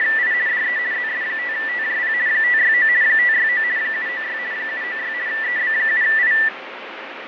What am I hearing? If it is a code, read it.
RTTY (50 baud, 170 Hz shift), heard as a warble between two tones, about 1850 Hz centre, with radio static and fading. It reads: … DE ZS5TJP 569 569 796 796 EB7I